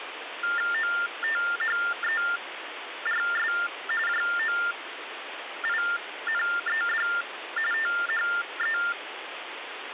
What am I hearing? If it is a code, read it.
TTY/TDD text telephone tones (45.45 baud Baudot), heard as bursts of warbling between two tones, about 400 Hz shift, 1600 Hz centre, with phone line noise. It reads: OTHERS JOINED THE